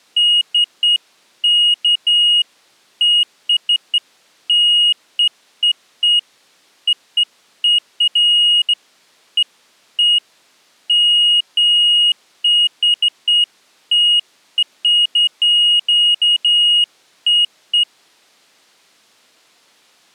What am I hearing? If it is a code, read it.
Beeps of irregular length. There is no code.